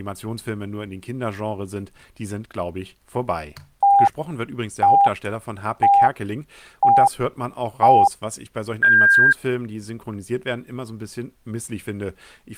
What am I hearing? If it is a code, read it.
Radio time signal (five pips and a higher one, as on Chinese radio), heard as pips, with speech in German.